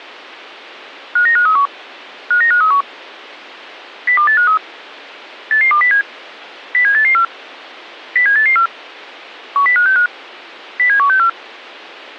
Five-tone selective call (CCIR), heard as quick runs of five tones, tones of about 100 ms. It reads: 59531 59531 02853 88207 07884 07884 10565 07164